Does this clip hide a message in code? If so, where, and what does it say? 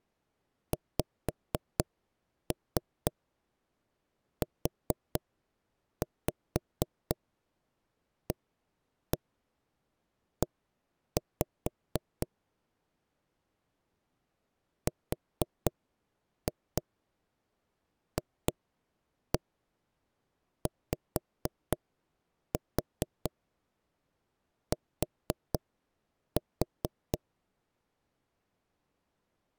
Yes: tap code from 0.7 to 27.2 s, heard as knocks on wood, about 4 knocks a second. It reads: XUAE RFYT